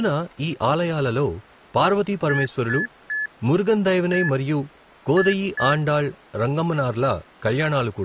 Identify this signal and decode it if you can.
Beep code, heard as beeps from a small speaker, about 1700 Hz, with speech in Telugu. 3-1-2. In Phoenix BIOS tables: DMA register failure.